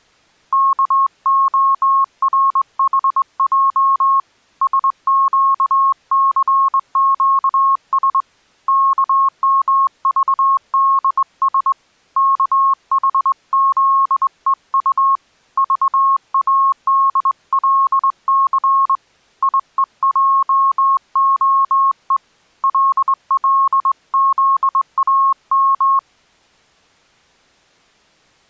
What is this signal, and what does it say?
Morse code, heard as a keyed tone, hand-sent with a straight key, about 21 wpm, 1090 Hz. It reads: KORHJ SQCQS KMVDS KHZEU VADLC IEJOE LLZAM